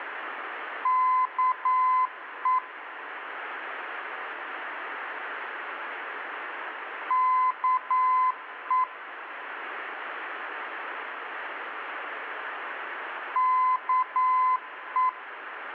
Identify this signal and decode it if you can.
Morse code, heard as a keyed tone, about 9 wpm, 1020 Hz. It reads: KE KE KE